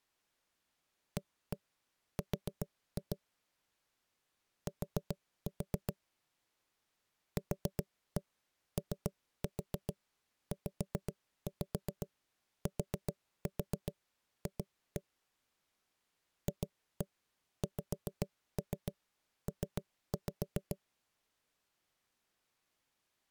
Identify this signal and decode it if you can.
Tap code, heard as knocks on wood, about 7 knocks a second. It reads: AR T QOZTF FXP